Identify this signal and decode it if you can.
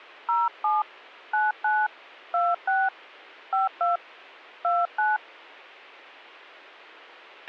DTMF, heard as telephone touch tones, dialled by hand, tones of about 200 ms, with a squelch burst at the end. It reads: 07 99 26 52 29